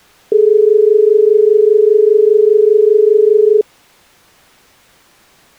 Telephone call progress tone (as in Australia), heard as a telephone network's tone, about 430 Hz. Dial tone.